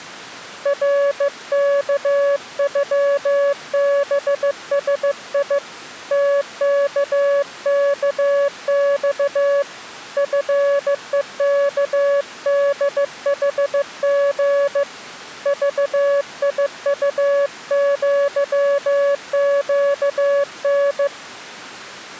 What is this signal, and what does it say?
Morse code (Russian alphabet), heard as a keyed tone, hand-sent with a bug key, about 15 wpm, 560 Hz. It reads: РКЮБСИ ТККЬ ФЕКДХГ ЖИУЪЩН